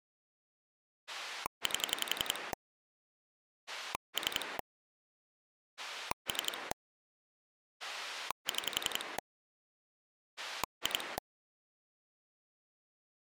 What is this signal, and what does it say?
Pulse dialling, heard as a rotary dial, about 11 pulses a second. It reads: 8 3 3 6 2